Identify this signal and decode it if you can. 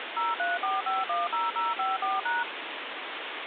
DTMF, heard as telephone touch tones, dialled by machine, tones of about 180 ms, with phone line noise. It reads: 034510054#